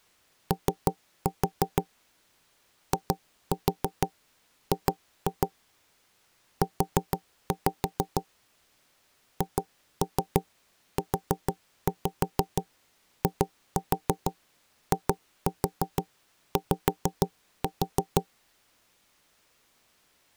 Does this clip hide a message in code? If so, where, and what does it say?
Yes: tap code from 0.5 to 18.3 s, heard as knocks on wood, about 6 knocks a second. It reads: O IG U HUIIY